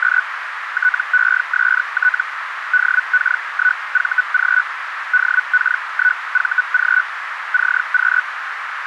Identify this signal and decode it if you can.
Hellschreiber (Feld-Hell, 122.5 baud), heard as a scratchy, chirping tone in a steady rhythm, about 1490 Hz, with radio static and a narrow filter. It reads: … TEST DK1VG DK1VG CQ